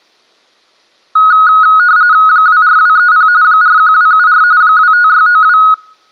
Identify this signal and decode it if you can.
RTTY (45.45 baud, 170 Hz shift), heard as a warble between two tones, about 1360 Hz centre. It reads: 24230 41274 25692